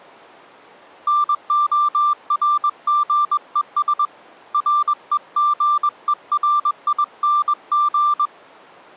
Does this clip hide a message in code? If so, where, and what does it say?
Yes: Morse code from 1.0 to 8.3 s, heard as a keyed tone, hand-sent with a bug key, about 21 wpm, 1180 Hz. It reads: NORGES REGERING